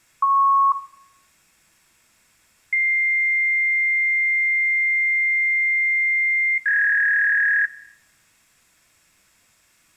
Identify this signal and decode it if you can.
Fax machine handshake, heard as a beep, a long tone and a warble, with room echo.